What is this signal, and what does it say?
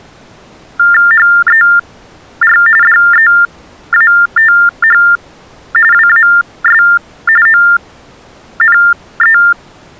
TTY/TDD text telephone tones (45.45 baud Baudot), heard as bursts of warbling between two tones, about 400 Hz shift, 1600 Hz centre. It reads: HER DEATH WAS ONE